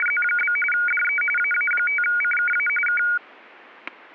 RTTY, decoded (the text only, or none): … DE AA5CKA K